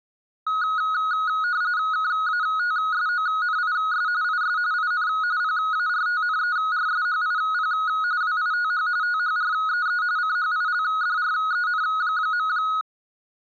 RTTY (45.45 baud, 170 Hz shift), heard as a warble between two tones, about 1360 Hz centre. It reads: KATSONIS IS IN PARTNERSHIP WITH THREE CHILDREN.